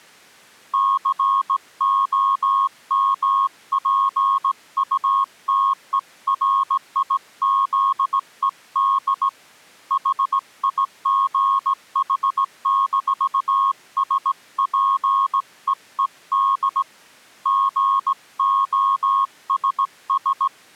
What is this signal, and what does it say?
Morse code, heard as a keyed tone, hand-sent with a straight key, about 17 wpm, 1090 Hz. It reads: COMPUTERIZED HIGH-SPEED GOSS